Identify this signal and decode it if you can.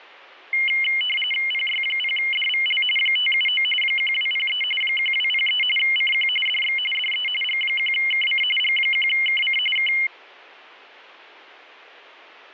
RTTY (45.45 baud, 850 Hz shift), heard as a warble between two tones, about 2550 Hz centre. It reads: PY0DVL 579 1203 1203 CQ DX DE G1KC G1KC K